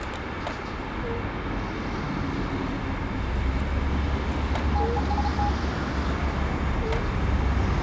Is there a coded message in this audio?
Yes: Morse code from 4.7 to 5.5 s, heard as a keyed tone, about 34 wpm, 820 Hz, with radio static and street noise. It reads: TEST